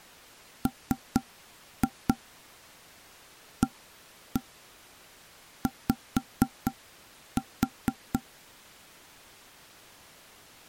Tap code, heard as knocks on wood, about 4 knocks a second. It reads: MAY